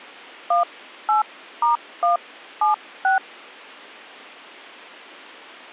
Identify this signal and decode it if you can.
DTMF, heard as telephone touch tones, dialled by hand, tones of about 130 ms. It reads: 18*176